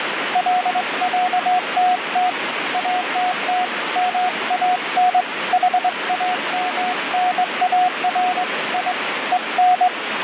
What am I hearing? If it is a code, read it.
Morse code (with Swedish letters), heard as a keyed tone, hand-sent with a straight key, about 22 wpm, 730 Hz, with radio static. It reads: LÄTT ATT MAN HAMNAR I EN